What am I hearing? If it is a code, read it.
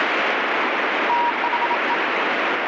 Morse code, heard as a keyed tone, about 27 wpm, 950 Hz, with heavy radio static. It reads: THE